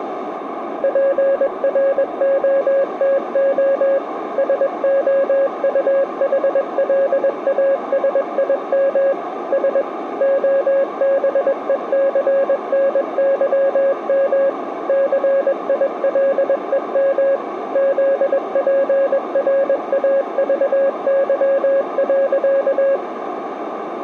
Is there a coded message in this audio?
Yes: Morse code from 0.8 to 23.0 s, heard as a keyed tone, machine-sent, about 21 wpm, 550 Hz, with radio static and a narrow filter. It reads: PROTO SOUHLASIM S OBECNYM CILEM ZPRAVY.